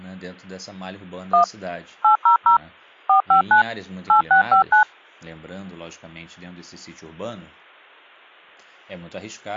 DTMF, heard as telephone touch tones, dialled by machine, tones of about 110 ms, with speech in Portuguese. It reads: 1 800 459 8659